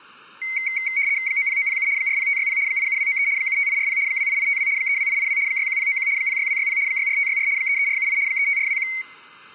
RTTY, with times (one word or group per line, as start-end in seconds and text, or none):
1.3-1.9 90907
2.0-2.6 40560
2.7-3.3 87293
3.4-4.0 75840
4.1-4.7 28852
4.8-5.4 32882
5.5-6.1 61091
6.2-6.8 06260
6.9-7.5 64564
7.6-8.2 33478
8.3-8.9 35421